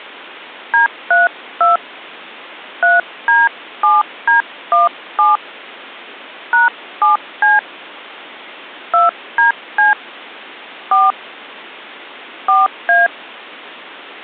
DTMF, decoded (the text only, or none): D32 3D7D17 #7C 2DC 4 4A